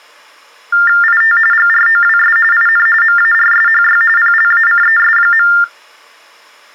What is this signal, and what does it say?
TTY/TDD text telephone tones (45.45 baud Baudot), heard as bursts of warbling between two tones, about 400 Hz shift, 1600 Hz centre. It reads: IT GROWS IN MARSHY PLACES.